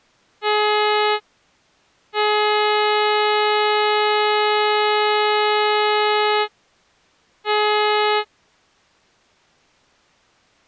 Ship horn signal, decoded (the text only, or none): 1 short, 1 long, 1 short